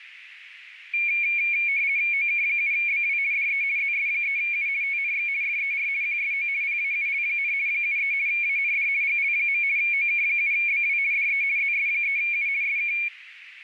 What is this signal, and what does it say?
RTTY (50 baud, 170 Hz shift), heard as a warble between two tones, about 2300 Hz centre, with radio static. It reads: OK7BW DE ZS3U TNX FER QSO PAUL, 73 AND GL. OK7BW DE ZS3U SK